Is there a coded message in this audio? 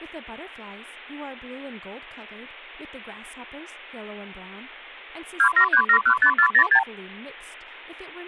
Yes: multi-frequency trunk signalling (R2, with the far end's replies) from 5.4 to 6.8 s, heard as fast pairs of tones, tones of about 80 ms, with speech in English. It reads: 273715406